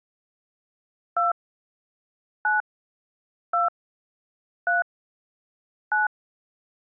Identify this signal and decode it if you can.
DTMF, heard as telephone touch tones, dialled by hand, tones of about 150 ms. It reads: 2 9 2 3 9